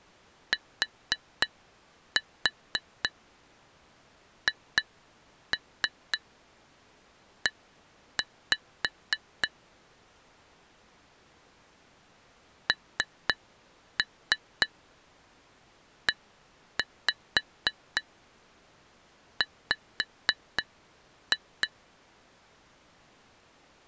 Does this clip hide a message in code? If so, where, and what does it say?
Yes: tap code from 0.5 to 21.7 s, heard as taps on glass, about 3 knocks a second. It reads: THE NEW